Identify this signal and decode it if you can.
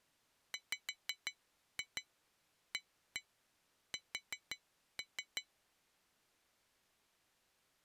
Tap code, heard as taps on glass, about 6 knocks a second. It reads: WAS